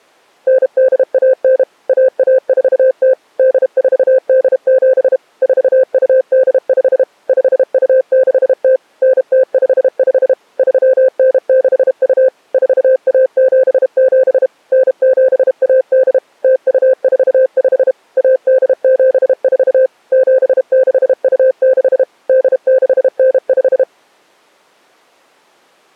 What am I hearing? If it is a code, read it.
Morse code (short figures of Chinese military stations), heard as a keyed tone, machine-sent, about 32 wpm, 520 Hz. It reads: 9819 1140 8487 4285 5260 9055 3962 4177 9718 0245 1874 7626 8695